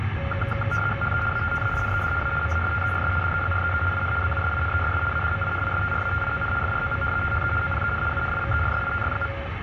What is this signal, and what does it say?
RTTY (75 baud, 850 Hz shift), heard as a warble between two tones, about 980 Hz centre, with radio static and the noise inside a car. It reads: HE ATTAINED A MASTERS DEGREE IN BUSINESS ADMINISTRATION FROM THE OPEN UNIVERSITY.